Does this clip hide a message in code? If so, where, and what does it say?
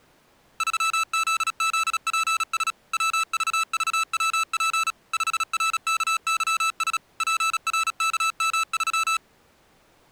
Yes: Morse code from 0.5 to 9.2 s, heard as electronic beeps, machine-sent, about 36 wpm, 1320 Hz. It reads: 3ZZPS WVVWP 5RKYS PRKM3